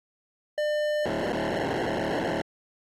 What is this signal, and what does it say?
POCSAG pager data (1200 baud), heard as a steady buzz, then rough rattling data.